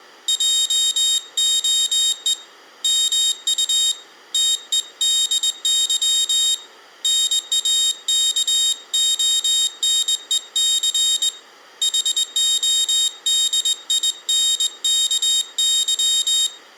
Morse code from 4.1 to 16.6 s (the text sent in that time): TEDY NAKONEC HODINKY